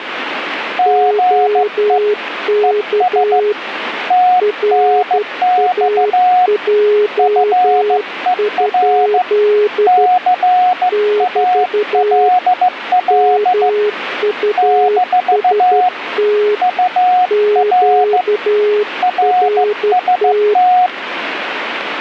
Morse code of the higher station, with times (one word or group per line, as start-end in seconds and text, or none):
0.8-2.0 GE
2.6-3.4 ES
4.1-6.5 TNX
7.2-9.2 FER
9.9-13.7 CALL
14.6-15.9 -
16.6-18.2 UR
19.0-20.9 RST